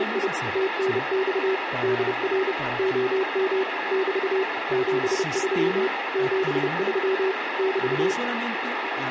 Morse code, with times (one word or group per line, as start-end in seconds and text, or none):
0.0-0.3 …
0.6-1.5 TNX
1.8-2.5 DR
2.8-3.6 OM
3.9-4.4 <BT>
4.7-5.9 73
6.2-7.3 73
7.6-8.1 <BT>